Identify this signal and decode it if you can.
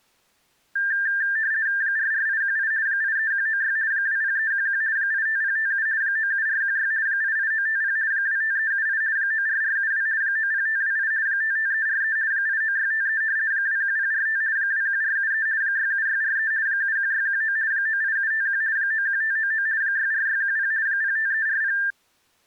RTTY (50 baud, 170 Hz shift), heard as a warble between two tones, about 1700 Hz centre. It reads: 44818 83196 20311 85057 97416 88950 25378 94472 90528 55343 89653 21045 21473 67643 71619 98751 91599 64610 05340